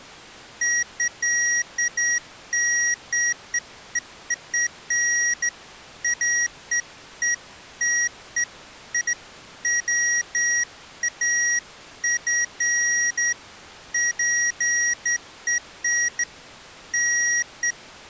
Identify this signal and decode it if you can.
Beeps of irregular length. There is no code.